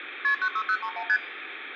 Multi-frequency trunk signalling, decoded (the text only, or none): KP 96031 ST